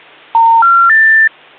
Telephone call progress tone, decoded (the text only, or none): special information tone